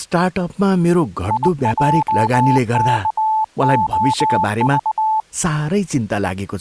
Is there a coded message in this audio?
Yes: Morse code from 1.2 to 5.3 s, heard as a keyed tone, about 21 wpm, 870 Hz, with speech in Nepali. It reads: IJKOV